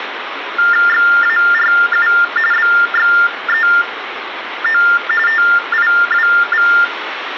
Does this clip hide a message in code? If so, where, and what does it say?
Yes: TTY/TDD text telephone tones (45.45 baud Baudot) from 0.6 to 6.8 s, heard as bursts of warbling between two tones, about 400 Hz shift, 1600 Hz centre, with phone line noise. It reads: XARU BXEO TIWV